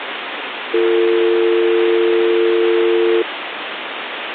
Telephone call progress tone (North American or UK plan), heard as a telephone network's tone, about 350, 450 Hz, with phone line noise. Dial tone.